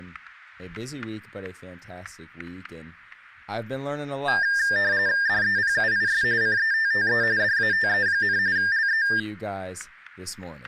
RTTY (45.45 baud, 170 Hz shift), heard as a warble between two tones, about 1700 Hz centre, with static crashes and speech in English. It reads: DEPUIS CETTE DATE, LE